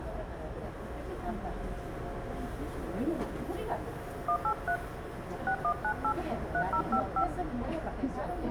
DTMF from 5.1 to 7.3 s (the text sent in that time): 6198 3055